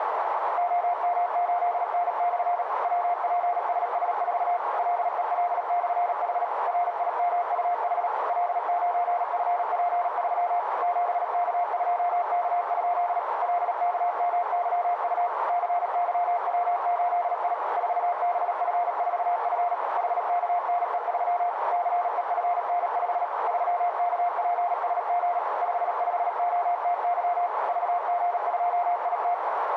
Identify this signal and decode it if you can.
Morse code, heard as a keyed tone, machine-sent, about 37 wpm, 700 Hz, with radio static and a narrow filter. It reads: OM8N/ WPSS4 LEL/H RIMUH L9FP3 7K2K? LKMYU CYW8I 4BF4F HKNE3 CEFN5 3KPSG 55OTY VG2IT